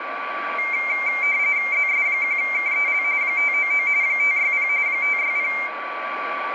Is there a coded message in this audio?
Yes: RTTY (45.45 baud, 170 Hz shift) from 0.6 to 5.7 s, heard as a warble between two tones, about 2200 Hz centre, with radio static, a steady whistle near 1150 Hz and room echo. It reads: ZS1KEL 599 560 560